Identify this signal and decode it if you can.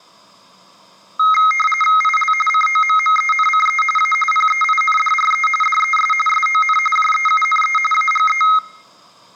RTTY (45.45 baud, 850 Hz shift), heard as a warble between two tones, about 1700 Hz centre, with room echo. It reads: IL COMMENCE A PEINDRE DES SON JEUNE AGE